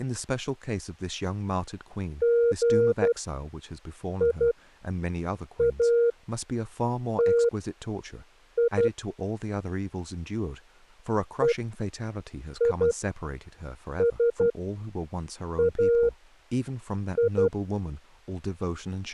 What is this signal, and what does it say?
Morse code (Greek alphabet), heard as a keyed tone, machine-sent, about 12 wpm, spaced as for 6 wpm, 470 Hz, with speech in English. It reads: ΓΙΑΤΙ ΕΙΣΑΙ